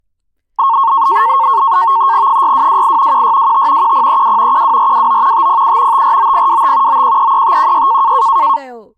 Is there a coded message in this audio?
Yes: NAVTEX (SITOR-B), 100 baud, 170 Hz shift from 0.6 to 8.6 s, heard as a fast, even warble, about 1000 Hz centre, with speech in Gujarati. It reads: 6228 1625 1032 12429 507 549025 9133516